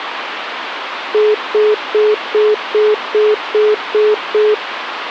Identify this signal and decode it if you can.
Telephone call progress tone (single-tone plan, as in most of Europe), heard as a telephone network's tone, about 420 Hz, 0.2 s on and 0.2 s off, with phone line noise. Congestion tone.